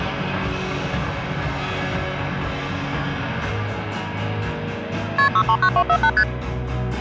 Multi-frequency trunk signalling (R1, as on North American trunks), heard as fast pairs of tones, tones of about 70 ms. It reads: KP 639248 ST